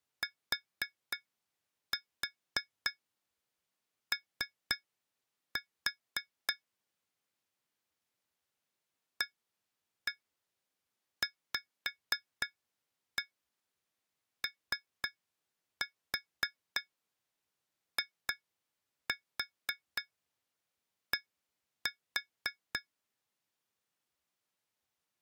Tap code, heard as taps on glass, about 3 knocks a second. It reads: TO AVOID